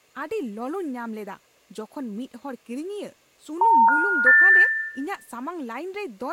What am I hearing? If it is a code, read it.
Telephone call progress tone (North American plan), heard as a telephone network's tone, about 910, 1430, 1800 Hz, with room echo and speech in Santali. Special information tone.